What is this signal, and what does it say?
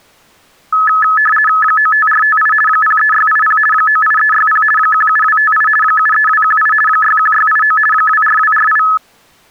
RTTY (50 baud, 450 Hz shift), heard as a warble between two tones, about 1500 Hz centre. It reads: 95458 03680 98360 17258 73218 61689 24248